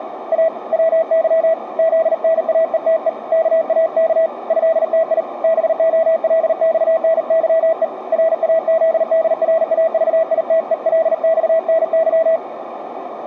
Morse code (Russian alphabet), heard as a keyed tone, hand-sent with a paddle, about 39 wpm, 650 Hz, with radio static and a narrow filter. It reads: А ВЫ ЗНАЕТЕ КАК ЭТИ БОЛЬНЫЕ РАЗДРАЖИТЕЛЬНЫ